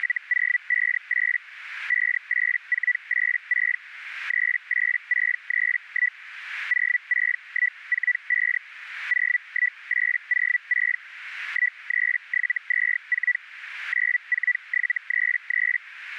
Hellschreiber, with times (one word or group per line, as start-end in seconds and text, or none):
0.0-1.4 …
1.9-3.8 58486
4.3-6.2 38631
6.7-8.6 06145
9.1-11.0 01806
11.5-13.4 13724
13.9-15.8 94733